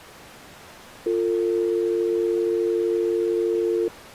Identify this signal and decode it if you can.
Telephone call progress tone (North American or UK plan), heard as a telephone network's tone, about 350, 450 Hz. Dial tone.